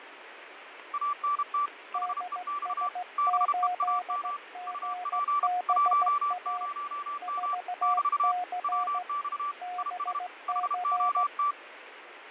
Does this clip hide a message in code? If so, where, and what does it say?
Yes: Morse code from 0.9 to 11.6 s, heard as two keyed tones, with radio static and fading. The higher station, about 32 wpm, 1160 Hz: ANT HEX BEAM UP 10M <BT> WX IS HOT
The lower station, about 16 wpm, 720 Hz: DS8GBA 4C BC